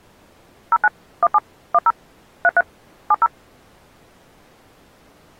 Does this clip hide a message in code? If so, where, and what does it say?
Yes: DTMF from 0.7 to 3.3 s, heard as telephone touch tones, dialled by machine, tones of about 40 ms. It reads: 09 17 10 33 70